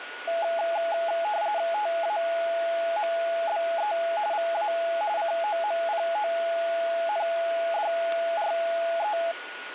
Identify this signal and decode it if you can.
RTTY (45.45 baud, 170 Hz shift), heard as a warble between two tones, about 760 Hz centre, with radio static and a steady whistle near 1450 Hz. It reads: TAMBE VA COMPONDRE